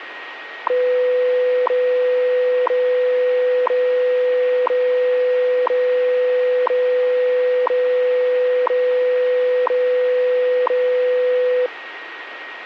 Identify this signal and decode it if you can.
Radio time signal (WWV, Colorado), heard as ticks, one a second, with radio static and a steady whistle near 1880 Hz.